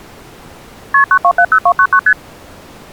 Multi-frequency trunk signalling (R1, as on North American trunks), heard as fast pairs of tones, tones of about 70 ms. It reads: KP 9270299 ST